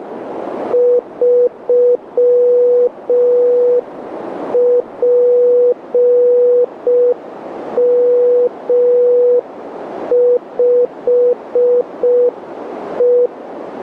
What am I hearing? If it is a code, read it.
Morse code, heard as a keyed tone, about 5 wpm, 490 Hz, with radio static and a narrow filter. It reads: 3PM5E